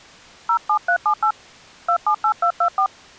DTMF, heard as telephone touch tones, dialled by hand, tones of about 80 ms. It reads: 07378 278224